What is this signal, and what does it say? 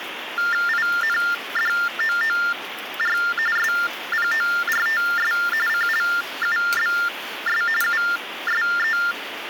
TTY/TDD text telephone tones (45.45 baud Baudot), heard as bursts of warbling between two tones, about 400 Hz shift, 1600 Hz centre, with phone line noise and kitchen noise. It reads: INDOOR SPORTS CLUBS USE